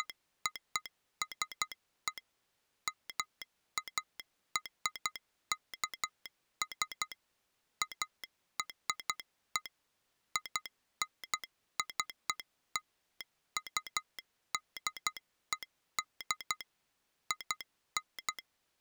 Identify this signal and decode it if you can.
Morse code (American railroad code), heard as a telegraph sounder, machine-sent. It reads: … MARKS ARE INCLUDED IN